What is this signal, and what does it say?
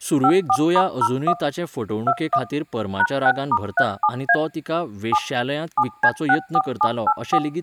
DTMF, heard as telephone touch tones, dialled by machine, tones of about 60 ms, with speech in Goan Konkani. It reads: 54*01 21 #6*37A 7 7C64784